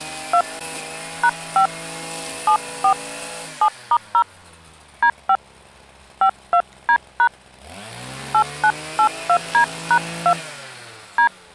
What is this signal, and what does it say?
DTMF, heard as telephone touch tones, dialled by hand, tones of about 80 ms. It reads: 2 #5 74 7*0 D5 52D# 8982D#2 D